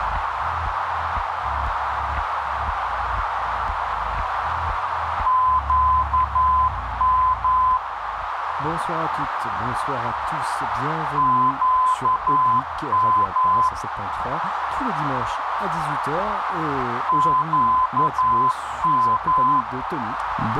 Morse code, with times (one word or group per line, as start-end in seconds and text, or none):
5.3-7.8 QM
11.2-13.7 QM
17.1-19.6 QM